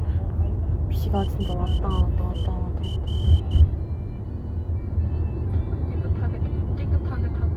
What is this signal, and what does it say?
Morse code, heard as a whistle, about 10 wpm, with the noise inside a car. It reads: HER